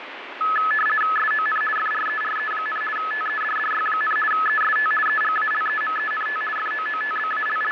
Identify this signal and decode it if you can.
RTTY (50 baud, 450 Hz shift), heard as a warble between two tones, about 1500 Hz centre, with radio static. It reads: SON FRERE, TEDDY, EST EGALEMENT …